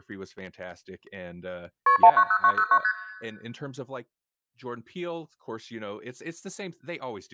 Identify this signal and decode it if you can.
Multi-frequency trunk signalling (R1, as on North American trunks), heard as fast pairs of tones, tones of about 70 ms, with speech in English. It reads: KP 190909 ST